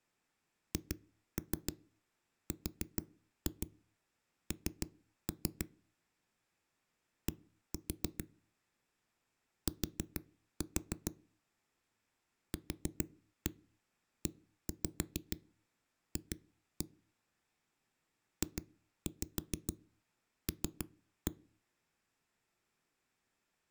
Tap code, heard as knocks on a wall, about 6 knocks a second. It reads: HRN D T QEF JL